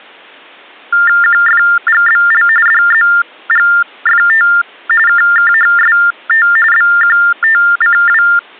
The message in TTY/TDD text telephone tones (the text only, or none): QFGBL DZGFT KKHST BQTCW